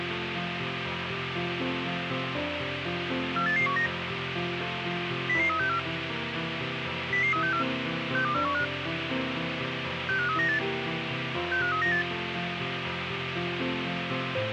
Five-tone selective call (CCIR), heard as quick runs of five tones, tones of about 100 ms, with radio hiss. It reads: 48819 00364 00364 62415 65398 65398